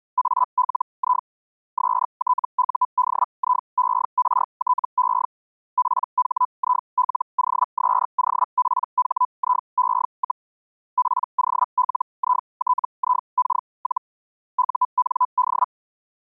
Hellschreiber (Feld-Hell, 122.5 baud), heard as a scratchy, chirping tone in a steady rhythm, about 1000 Hz. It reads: ALI STUDIERTE PHILOSOPHIE, POLITIK- UND